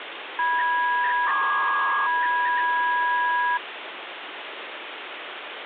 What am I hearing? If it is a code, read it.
300-baud modem data (V.21 tones), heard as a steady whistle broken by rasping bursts, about 300 baud, 200 Hz shift, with phone line noise.